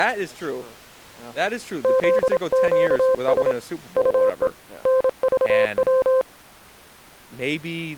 Morse code, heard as a keyed tone, hand-sent with a paddle, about 27 wpm, 520 Hz, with speech in English. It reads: ZQS UE NVW